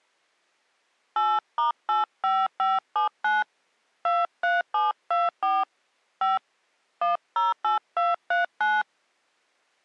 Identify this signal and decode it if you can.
DTMF, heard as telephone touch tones, dialled by hand, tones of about 180 ms. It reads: 8*85579 23724 5 108239